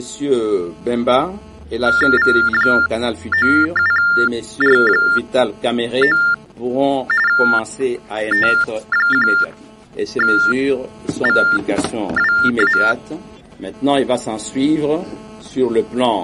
TTY/TDD text telephone tones (45.45 baud Baudot), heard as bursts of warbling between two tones, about 400 Hz shift, 1600 Hz centre. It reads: V97R9 T1VWA